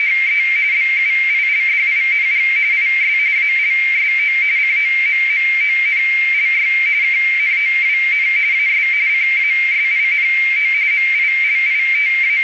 RTTY (45.45 baud, 170 Hz shift), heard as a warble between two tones, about 2200 Hz centre, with radio static and a narrow filter. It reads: … BUILDING IS ALSO COMMONLY KNOWN AS CASINO …